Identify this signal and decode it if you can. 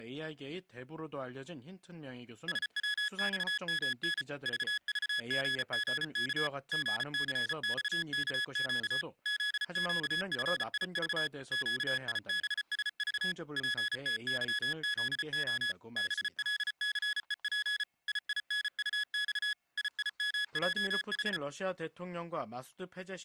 Morse code, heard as electronic beeps, machine-sent, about 34 wpm, 1700 Hz. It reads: SWXMN VVGGK GCXKQ ZQFIV QIBSV PTYZO BLCEP IINUX IIMJH